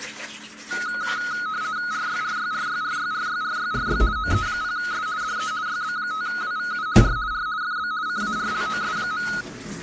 RTTY (50 baud, 170 Hz shift), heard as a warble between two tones, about 1360 Hz centre, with kitchen noise. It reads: RYRYRYRYRYRYRY OE0S DE YB5WVU R R FB CARLOS.